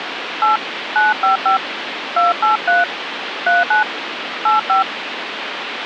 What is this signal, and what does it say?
DTMF, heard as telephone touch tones, dialled by hand, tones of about 130 ms, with phone line noise. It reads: 8 955 283 39 85